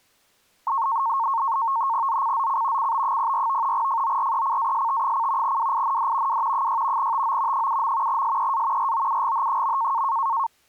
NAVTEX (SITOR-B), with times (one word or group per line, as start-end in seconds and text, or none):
2.1-2.9 ZCZC
2.8-3.7 CB04
3.7-5.6 FORECAST:
5.4-6.4 WIND
6.3-6.7 W
6.5-7.1 6
7.0-7.7 TO
7.5-8.2 7.
8.1-8.9 SEA
8.8-10.0 ROUGH.